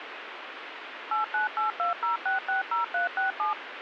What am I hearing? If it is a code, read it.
DTMF, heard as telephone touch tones, dialled by machine, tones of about 130 ms, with radio hiss. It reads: 89820660367